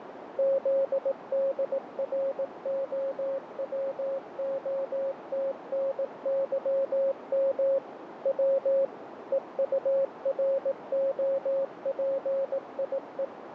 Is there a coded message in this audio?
Yes: Morse code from 0.3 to 13.3 s, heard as a keyed tone, machine-sent, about 18 wpm, 540 Hz, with radio static and a narrow filter. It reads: ZDROWOTNYM W EUROPIE